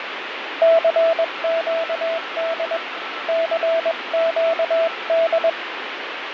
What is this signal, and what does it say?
Morse code, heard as a keyed tone, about 21 wpm, 660 Hz, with radio static, fading and a weaker station near 1330 Hz. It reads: CQD CQD